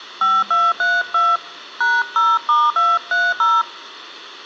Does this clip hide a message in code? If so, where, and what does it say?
Yes: DTMF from 0.2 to 3.6 s, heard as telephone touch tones, dialled by hand, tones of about 220 ms. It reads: 5232 #0*230